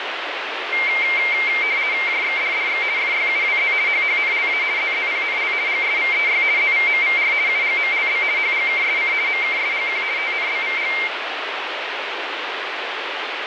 RTTY (50 baud, 170 Hz shift), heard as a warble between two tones, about 2200 Hz centre, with radio static. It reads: JXDDX FYUWZ HHNLA ZZPNL GSVEY ZVMVR UGMLB HGKSC MKSGQ TNBVG